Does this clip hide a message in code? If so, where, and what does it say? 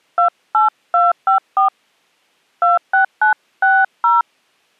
Yes: DTMF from 0.2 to 4.2 s, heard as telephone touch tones, dialled by hand, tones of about 160 ms. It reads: 28254 26960